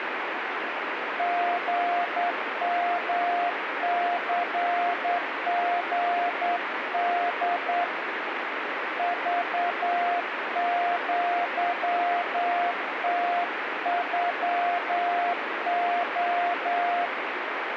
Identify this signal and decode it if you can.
Morse code (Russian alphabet), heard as a keyed tone, hand-sent with a straight key, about 9 wpm, 700 Hz, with radio static. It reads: ГМЦГД ЖЪТЮО